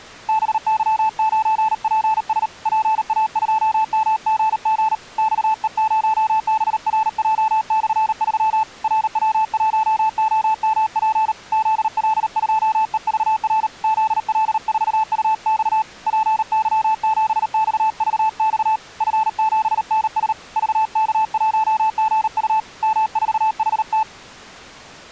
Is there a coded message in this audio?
Yes: Morse code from 0.2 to 24.1 s, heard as a keyed tone, hand-sent with a paddle, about 38 wpm, 880 Hz. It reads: BY9PS PA2MGG XE0BRJ/3 RW1OMP ZL2EVR ZL4UX PY7XVX F7NS VK1GU M4HT